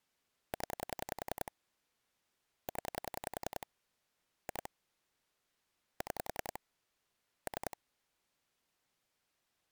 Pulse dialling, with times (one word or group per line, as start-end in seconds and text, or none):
0.5-1.5 0
2.7-3.7 0
4.5-4.7 2
6.0-6.6 6
7.5-7.8 3